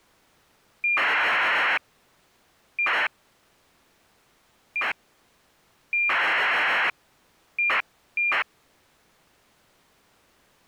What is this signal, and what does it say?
ACARS aircraft data, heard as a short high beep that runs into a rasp, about 2400 baud.